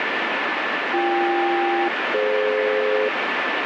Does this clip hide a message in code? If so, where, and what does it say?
Yes: aircraft SELCAL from 0.9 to 3.1 s, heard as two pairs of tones, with heavy radio static. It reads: BK-DF